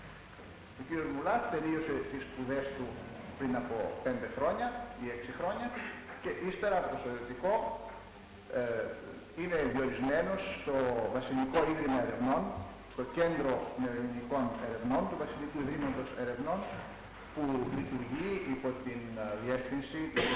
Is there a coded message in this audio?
No.